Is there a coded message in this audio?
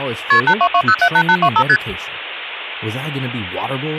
Yes: multi-frequency trunk signalling (R1, as on North American trunks) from 0.3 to 1.8 s, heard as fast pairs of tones, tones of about 70 ms, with speech in English. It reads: KP 822078825 ST